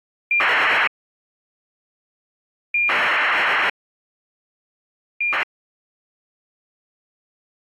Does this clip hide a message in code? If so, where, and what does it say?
Yes: ACARS aircraft data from 0.3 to 5.4 s, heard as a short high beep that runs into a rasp, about 2400 baud.